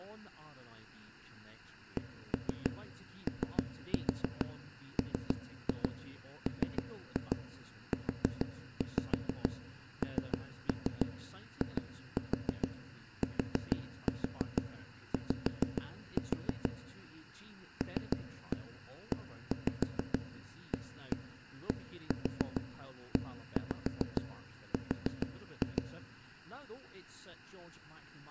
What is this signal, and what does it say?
Tap code, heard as knocks on wood, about 6 knocks a second, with speech in English. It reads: COMMUNITY LEADER